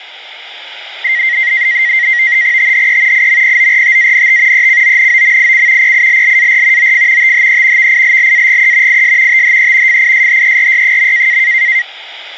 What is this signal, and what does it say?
NAVTEX (SITOR-B), 100 baud, 170 Hz shift, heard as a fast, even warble, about 2000 Hz centre, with radio static. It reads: THE IMPORTANT ECONOMIC PILLAR OF THE VILLAGE IS THE FISHERY.